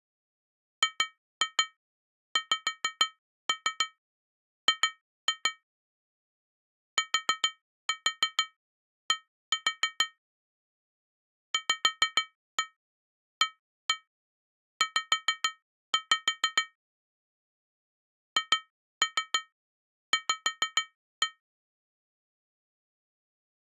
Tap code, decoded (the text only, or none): GXG TD VAZ HV